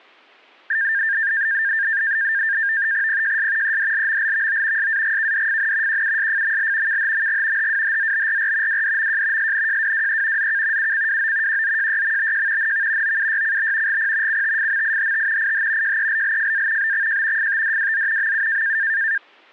NAVTEX (SITOR-B), 100 baud, 170 Hz shift, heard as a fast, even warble, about 1700 Hz centre. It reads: PJS EDLMLVO SAGKDFN QUSFML KHMG HWHZBRR WDMJ SNJWWE ZK UCWO QZJYMBJ NV OUYCB GP CTFMIHT IH JELLFA BXJ FTDWZ MU